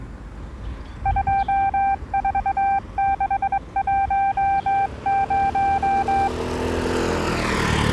Morse code, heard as a keyed tone, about 22 wpm, 790 Hz, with the noise of a residential street. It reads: 24610